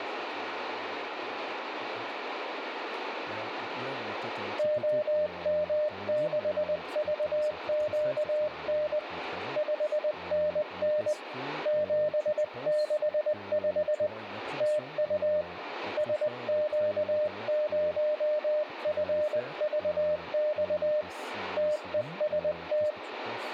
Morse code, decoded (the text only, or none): OM6VQN 5NN 765 TU SQ0FVX TEST